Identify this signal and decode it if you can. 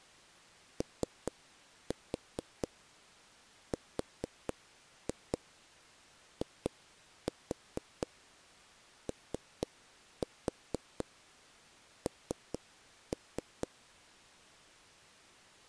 Tap code, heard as knocks on a wall, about 4 knocks a second. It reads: ORION